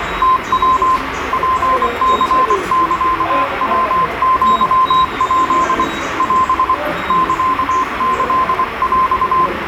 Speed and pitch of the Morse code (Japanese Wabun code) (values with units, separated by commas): 24 wpm, 1040 Hz